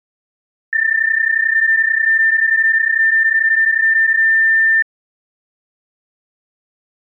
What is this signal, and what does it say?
PSK31 (31.25 baud), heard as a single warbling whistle, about 1800 Hz.